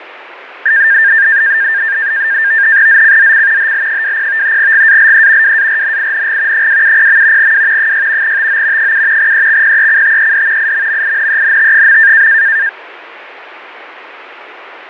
NAVTEX (SITOR-B), 100 baud, 170 Hz shift, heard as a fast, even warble, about 1700 Hz centre, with radio static. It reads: ZCZC HL20 GALE WARNING 270. W 6 TO 7 EXPECTED IMMINENT.